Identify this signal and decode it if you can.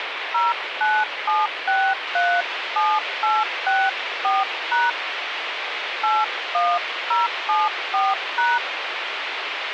DTMF, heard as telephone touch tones, dialled by hand, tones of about 220 ms, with phone line noise. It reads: 097637864# 81074#